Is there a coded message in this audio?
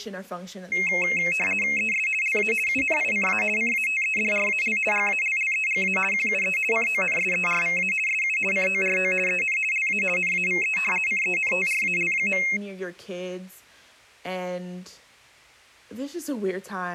Yes: RTTY (50 baud, 450 Hz shift) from 0.7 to 12.6 s, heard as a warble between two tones, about 2350 Hz centre, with speech in English. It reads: ES LA UNICA CATEDRAL GALLEGA QUE CONSERVA SU CORO EN LA NAVE CENTRAL.